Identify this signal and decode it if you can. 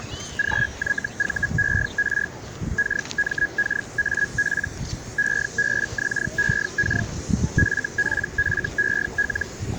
Hellschreiber (Feld-Hell, 122.5 baud), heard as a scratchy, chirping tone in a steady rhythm, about 1650 Hz, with the noise of a park. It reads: GYVER KMKAP EBXEK FPFEL